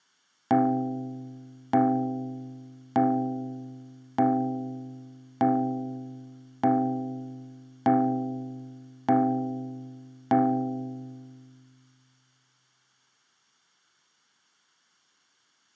Clock strike, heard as a bell. 9. Nine o'clock.